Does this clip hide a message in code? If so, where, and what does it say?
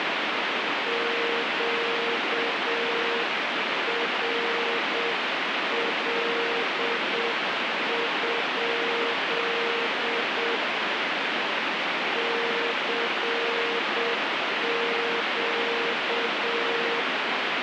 Yes: Morse code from 0.8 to 17.1 s, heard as a keyed tone, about 7 wpm, 470 Hz, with heavy radio static. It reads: QRL? CQ